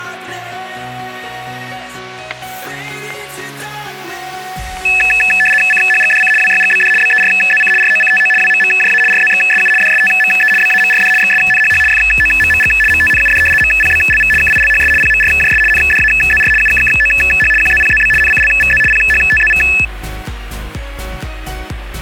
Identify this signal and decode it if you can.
RTTY (75 baud, 850 Hz shift), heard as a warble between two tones, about 2150 Hz centre, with static crashes. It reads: CHGDC WYGBD BERZC ROCTO WMMJA RZXSU DSTME BAMRD XSNHH FOMMG MTNUD MPBLV KILHS PMRJS NDAZR UKKOH QZPZB NCLVZ PHTZV